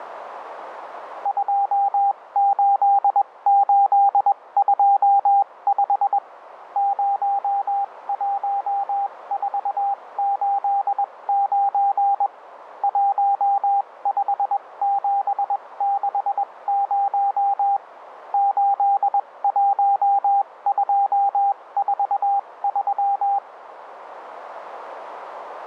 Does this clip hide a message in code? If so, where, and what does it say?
Yes: Morse code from 1.2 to 23.4 s, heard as a keyed tone, machine-sent, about 21 wpm, spaced as for 18 wpm, 800 Hz, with radio static and a narrow filter. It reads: 28825 01489 15760 81243